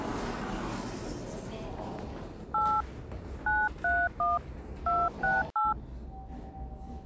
DTMF, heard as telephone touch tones, dialled by hand, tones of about 200 ms, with the noise inside a lift. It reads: 8 931 268